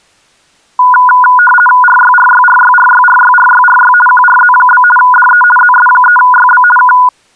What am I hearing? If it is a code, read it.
RTTY (50 baud, 450 Hz shift), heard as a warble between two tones, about 1220 Hz centre. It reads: RYRYRYRYRYRYRY QRZ? DE ZS3YB K